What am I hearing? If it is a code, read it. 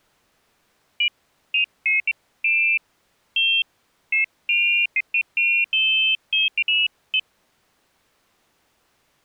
Pairs of high tones at irregular times. There is no code.